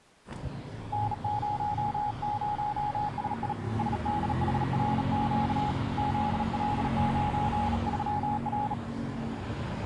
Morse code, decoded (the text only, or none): N00SI SDHRQ ZL93R